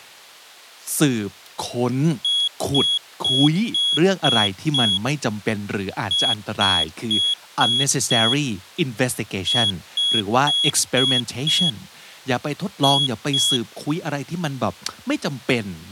Beep code, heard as a piezo beeper, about 3350 Hz, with speech in English. 6-5-5-2.